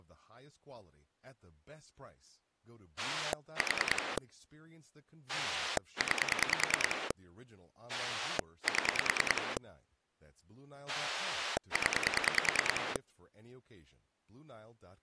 Pulse dialling, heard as a rotary dial, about 10 pulses a second, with speech in English. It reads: 4 9 7 0